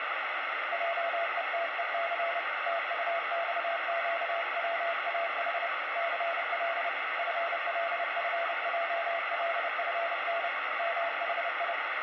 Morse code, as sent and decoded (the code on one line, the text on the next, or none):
.--- . - . -.-. / - ..- -..- --.- .-- .- .... / -.-. .-.. / ..-. .-.. ..-. .--- .-.. ..-. -. / -- .... ..
JETEC TUXQWAH CL FLFJLFN MHI